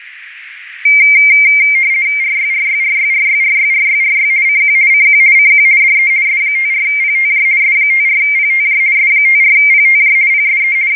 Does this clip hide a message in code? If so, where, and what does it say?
Yes: RTTY (50 baud, 170 Hz shift) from 0.9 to 11.0 s, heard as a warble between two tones, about 2200 Hz centre, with radio static. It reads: RYRYRYRYRYRYRY CQ CQ CQ DE S54PTJ S54PTJ S54PTJ PSE …